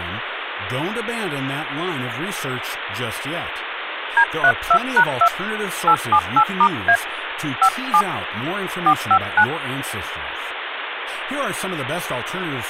DTMF, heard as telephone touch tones, dialled by hand, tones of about 70 ms, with phone line noise and speech in English. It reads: D32#2 878*A 57 459